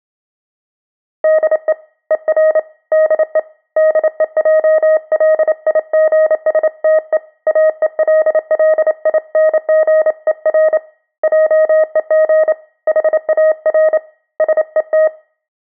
Morse code, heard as a keyed tone, hand-sent with a paddle, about 28 wpm, 630 Hz, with room echo. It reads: DE ER DE DEJLIGSTE AELLINGER JEG HAR SET